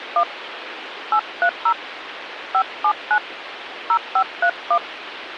DTMF, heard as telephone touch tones, dialled by hand, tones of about 70 ms, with phone line noise. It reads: 1 830 579 0531